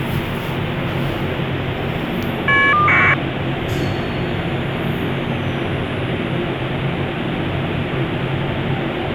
Caller ID data burst, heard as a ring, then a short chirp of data, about 1200 baud, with phone line noise and the noise inside a lift.